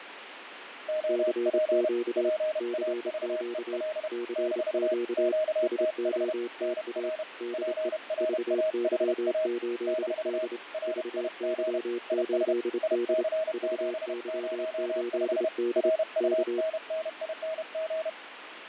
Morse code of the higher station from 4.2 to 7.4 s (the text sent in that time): - QTH NR